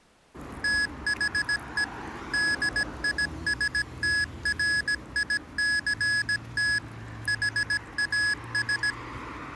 Morse code, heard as electronic beeps, machine-sent, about 17 wpm, 1700 Hz, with street noise. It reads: THE DISTRICT HAS